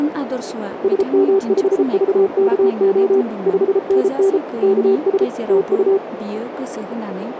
Morse code, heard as a keyed tone, machine-sent, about 33 wpm, 390 Hz, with radio static, a narrow filter and speech in Bodo. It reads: SM5VKO 5NN KS TU